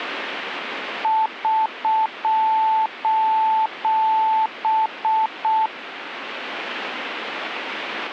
Morse code, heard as a keyed tone, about 6 wpm, 880 Hz. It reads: <SOS>